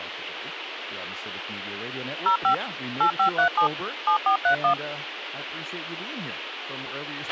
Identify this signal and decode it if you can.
DTMF, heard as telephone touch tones, dialled by machine, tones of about 100 ms, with radio hiss and a squelch burst at the end. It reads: 05 8537 7431